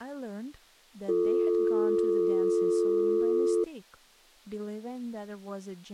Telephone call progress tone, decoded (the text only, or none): dial tone